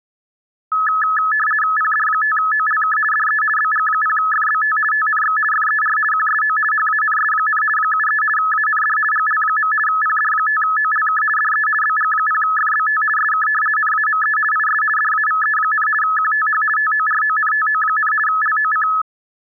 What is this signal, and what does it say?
RTTY (50 baud, 450 Hz shift), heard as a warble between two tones, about 1500 Hz centre. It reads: PD5OLK DE BG0FBT TNX FER QSO HANS, 73 AND GL. PD5OLK DE BG0FBT SK NAME IS DAVE, QTH TORONTO, LOC